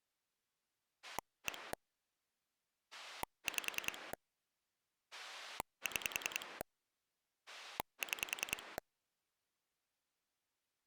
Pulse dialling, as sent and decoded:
1 / 5 / 6 / 6
1 5 6 6

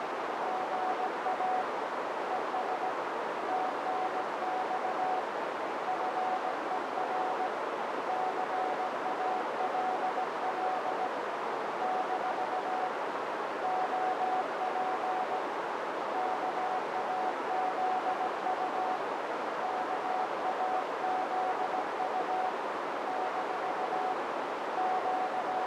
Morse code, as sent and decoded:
--. .- / . ... / - -. -..- / ..-. . .-. / -.-. .- .-.. .-.. / -....- / --- .--. / -.- .- --.. ..- / -.- .- --.. ..- / -....- / …
GA ES TNX FER CALL - OP KAZU KAZU - …

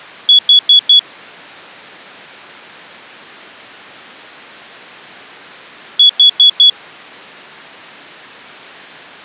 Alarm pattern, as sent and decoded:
4 beeps and a pause
temporal four

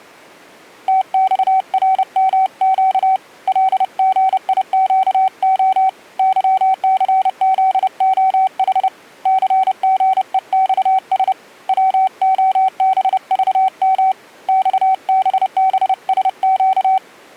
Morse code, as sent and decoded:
- -..- .-. -- --.- / .-.. --. .. --.- --- / -.-- -.-. --.. --- .... / -.-. --. . -..- ... / .-- --- -... ...- -- / -..- -... -... ... --.-
TXRMQ LGIQO YCZOH CGEXS WOBVM XBBSQ

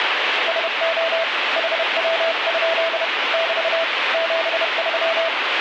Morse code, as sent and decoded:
... --- / .... .-- ..--.. / -...- / --... ...--
SO HW? <BT> 73

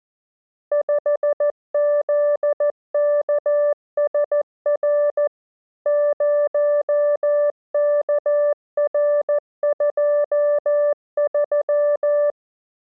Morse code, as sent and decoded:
..... --.. -.- ... .-. / ----- -.- .-. ..--- ...--
5ZKSR 0KR23

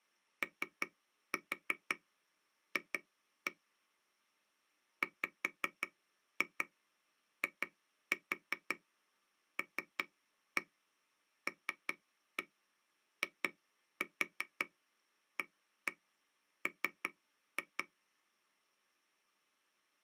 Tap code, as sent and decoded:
3-4 2-1 / 5-2 2-4 3-1 3-1 2-4 1-1 3-2
OF WILLIAM

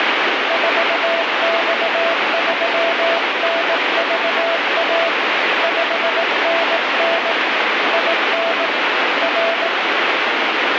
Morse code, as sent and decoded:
....- -..- ...-- -. ...- .- / ..... -. -. / .. -. / .-.
4X3NVA 5NN IN R

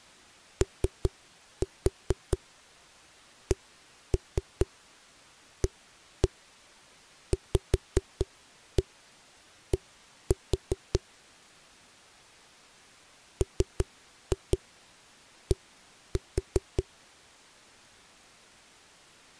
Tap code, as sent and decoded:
3-4 1-3 1-1 5-1 1-4 / 3-2 1-4
OCAVD MD

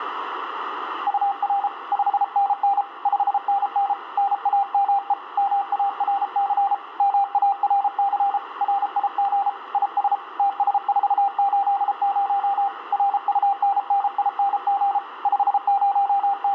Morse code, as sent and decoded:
..- .-. / ..... -. -. / ..... -. -. / -. .- -- . / -- .- .-. -.-. / -- .- .-. -.-. / .-. .. --. / .. ... / - ... ....- ---.. ----- / .-. ..- -. -. .. -. --. / …
UR 5NN 5NN NAME MARC MARC RIG IS TS480 RUNNING …

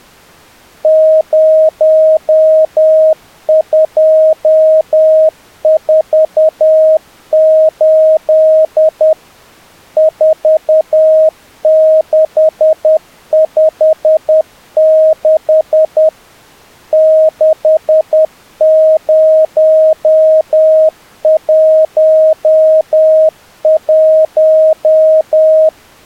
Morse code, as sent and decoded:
----- ..--- ....- ---.. / ....- -.... ..... -.... / -.... ----- .---- .----
0248 4656 6011

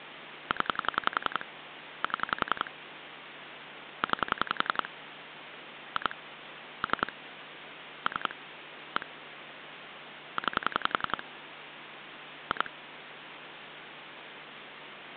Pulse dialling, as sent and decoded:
10 / 7 / 9 / 2 / 3 / 3 / 1 / 9 / 2
0 7 9 2 3 3 1 9 2

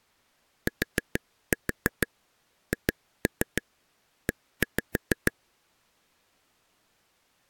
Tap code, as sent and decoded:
4-4 2-3 1-5
THE

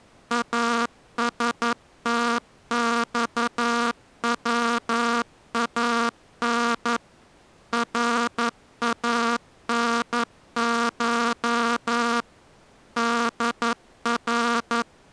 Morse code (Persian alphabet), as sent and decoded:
.- ... - -..- .-- .- -. / .-. .- -. ---- / -.. .-.
استخوان رانش در

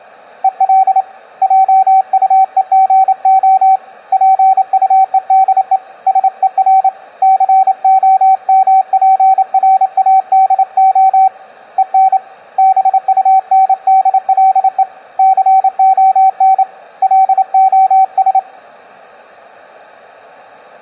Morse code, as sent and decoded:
. .-.. / .--- ..- . --. --- / .--. ..- . -.. . / ... . .-. / -.-. --- -- .--. .-. .- -.. --- / . -. / -... ..- -. -.. .-.. . / -.-. --- -. / .-.. --- ...
EL JUEGO PUEDE SER COMPRADO EN BUNDLE CON LOS

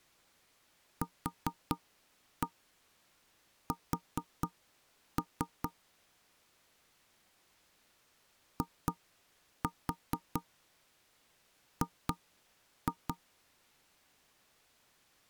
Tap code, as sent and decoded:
4-1 4-3 / 2-4 2-2
QS IG

